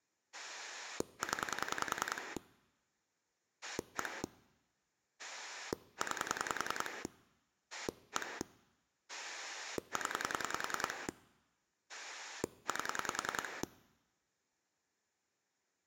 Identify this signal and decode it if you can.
Pulse dialling, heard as a rotary dial, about 10 pulses a second. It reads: 0 1 9 1 0 8